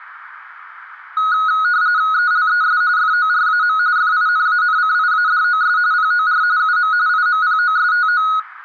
RTTY (45.45 baud, 170 Hz shift), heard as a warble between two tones, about 1360 Hz centre. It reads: ELES FORAM FINANCIADOS POR UM IMPOSTO